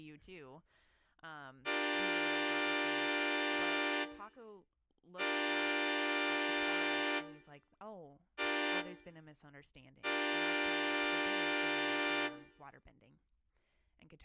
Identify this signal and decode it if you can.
Train horn signal, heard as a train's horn, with room echo and speech in English. 2 long, 1 short, 1 long. On North American railways: approaching a public crossing.